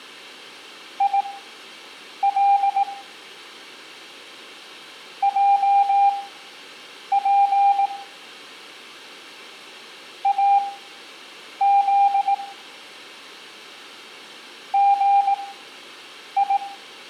Morse code, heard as a keyed tone, machine-sent, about 18 wpm, spaced as for 7 wpm, 800 Hz, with room echo. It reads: IL JP AZ GI